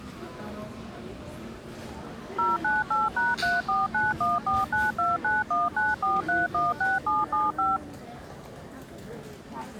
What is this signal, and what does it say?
DTMF, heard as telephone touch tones, dialled by machine, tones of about 180 ms, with the noise of a crowd indoors. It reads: 098#34914929194316775